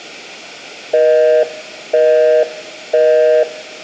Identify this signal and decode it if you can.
Telephone call progress tone (North American plan), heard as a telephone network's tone, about 480, 620 Hz, 0.5 s on and 0.5 s off, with room echo. Busy tone.